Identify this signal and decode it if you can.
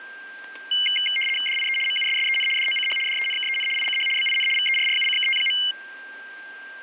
RTTY (75 baud, 850 Hz shift), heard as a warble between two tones, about 2550 Hz centre, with static crashes and a steady whistle near 1580 Hz. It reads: DIE MUSSEN DOCH DENKEN ICH BIN VERRUCKT.